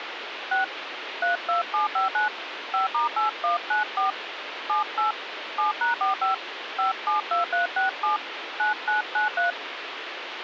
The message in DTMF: 6 32759 5*8194 78 7#45 572367 9993

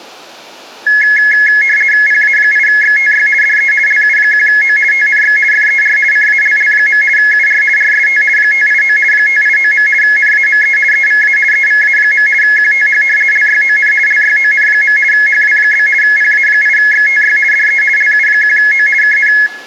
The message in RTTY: PA8XTY DE LU1O TNX FER CALL. UR RST 589 589. NAME EVA EVA. QTH LYON LYON. HW? PA8XTY DE LU1O KN

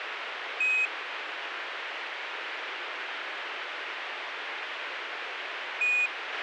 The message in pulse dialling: none

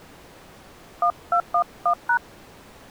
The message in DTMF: 1211#

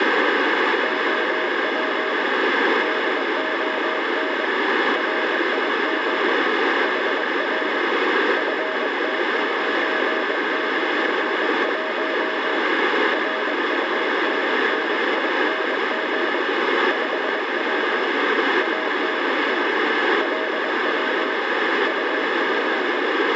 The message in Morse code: OP DON RIG HR FT991 RUNNING 5W ANT LW UP

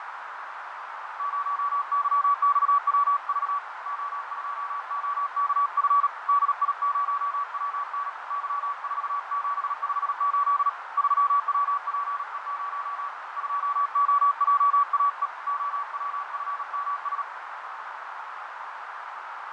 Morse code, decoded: 0YXWV O2OKF DI0WN Y4758 3WPE0 2OJAE OWFMS

